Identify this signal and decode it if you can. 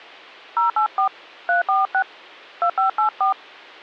DTMF, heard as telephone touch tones, dialled by hand, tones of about 120 ms. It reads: 084 346 2584